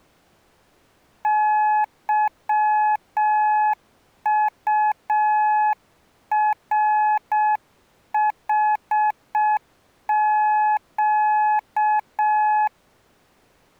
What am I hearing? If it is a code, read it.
Morse code, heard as a keyed tone, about 6 wpm, 850 Hz. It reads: YURHQ